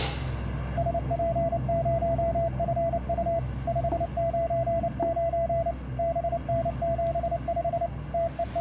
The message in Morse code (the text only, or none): SP0FU 599 BN75 …